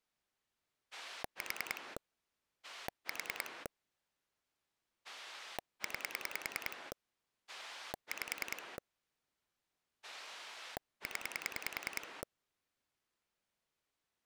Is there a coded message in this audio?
Yes: pulse dialling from 0.9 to 12.2 s, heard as a rotary dial, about 10 pulses a second. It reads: 4 4 9 5 0